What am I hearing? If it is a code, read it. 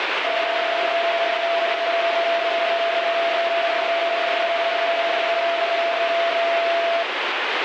PSK31 (31.25 baud), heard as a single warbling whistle, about 680 Hz, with radio static.